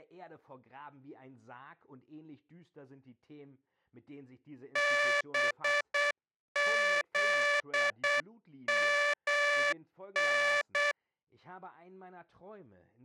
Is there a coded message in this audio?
Yes: Morse code (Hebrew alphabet) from 4.7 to 11.0 s, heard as a buzzer, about 8 wpm, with speech in German. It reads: בזמן